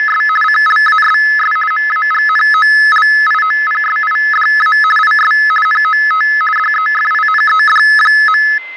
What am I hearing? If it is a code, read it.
RTTY (50 baud, 450 Hz shift), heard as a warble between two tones, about 1500 Hz centre, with fading and a steady whistle near 2070 Hz. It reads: … CLASS MAGNOLIOPSIDA IS NOT DEFINED.